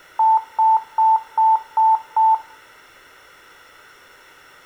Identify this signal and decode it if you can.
Beep code, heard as beeps, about 880 Hz, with room echo. 6 short. In AMI BIOS tables: keyboard controller gate A20 failure; in Dell tables: video card failure.